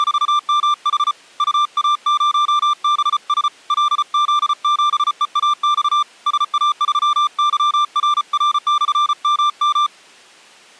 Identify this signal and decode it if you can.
Morse code, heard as a keyed tone, hand-sent with a paddle, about 34 wpm, 1180 Hz. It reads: … UA0BS LZ7EAX SA3YRR/MM